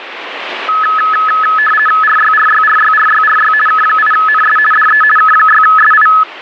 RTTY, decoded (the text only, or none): RYRYRYRYRY K8NS DE K6SI